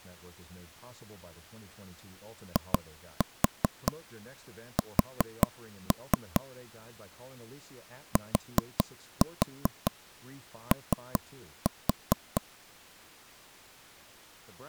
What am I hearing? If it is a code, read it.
Tap code, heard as taps on a table, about 5 knocks a second, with speech in English. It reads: IS TO